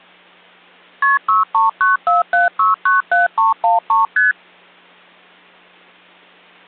Multi-frequency trunk signalling (R1, as on North American trunks), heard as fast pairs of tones, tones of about 150 ms. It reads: KP 63947697313 ST